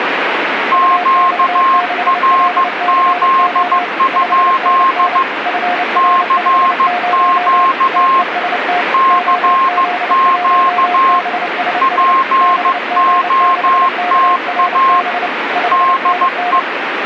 Morse code, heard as two keyed tones, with radio static. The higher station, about 15 wpm, 1060 Hz: QRZ? CQ CQ POTA DE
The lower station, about 29 wpm, 710 Hz: UX6LCO 5NN FR50 TEST OZ1BSS BG6KRB 5NN